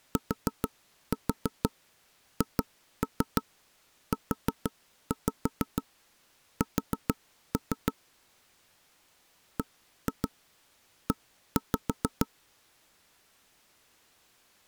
Tap code, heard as taps on a table, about 6 knocks a second. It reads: THUS BE